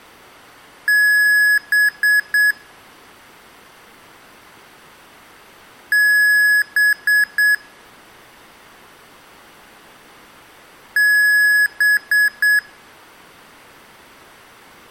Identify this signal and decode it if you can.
Beep code, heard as beeps from a small speaker, played three times, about 1700 Hz. 1 long, 3 short. In Award and IBM BIOS tables: video adapter failure; in AMI BIOS tables: memory failure.